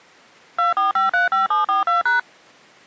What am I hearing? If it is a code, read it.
DTMF, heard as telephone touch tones, dialled by machine, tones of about 140 ms. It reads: 24535742#